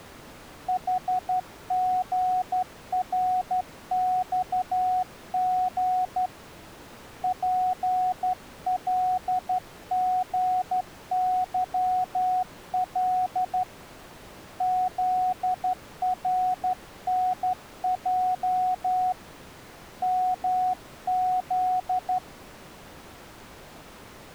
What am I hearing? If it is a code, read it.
Morse code, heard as a keyed tone, hand-sent with a straight key, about 12 wpm, 740 Hz. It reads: HGRXG PLGYL ZRNJ MZ